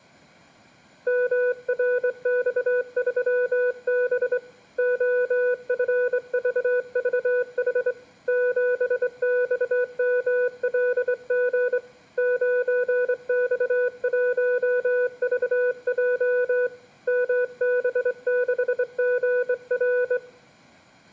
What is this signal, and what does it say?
Morse code, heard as a keyed tone, hand-sent with a straight key, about 24 wpm, 500 Hz, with room echo. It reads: MRX3B OFVVH 7XMLG 9X1VJ MB6GR